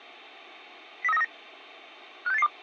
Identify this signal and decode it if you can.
Five-tone selective call (EEA), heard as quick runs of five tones, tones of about 40 ms. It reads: 03939 56882